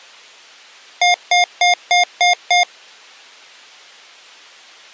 Beep code, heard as beeps from a small speaker, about 710 Hz. 6 short. In AMI BIOS tables: keyboard controller gate A20 failure; in Dell tables: video card failure.